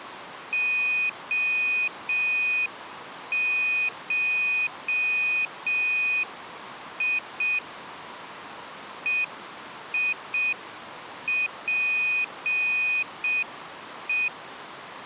Morse code (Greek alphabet), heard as a high beeper, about 6 wpm, 2500 Hz. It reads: ΟΧΙ ΕΙΠΕ